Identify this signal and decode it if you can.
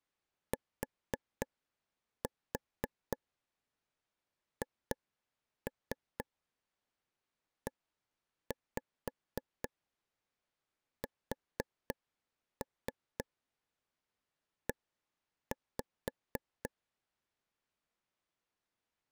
Tap code, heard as taps on a table, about 4 knocks a second. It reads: THESE